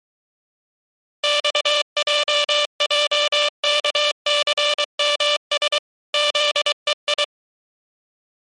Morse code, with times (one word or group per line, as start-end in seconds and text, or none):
1.2-5.8 XJJKCMS
6.1-7.2 ZEI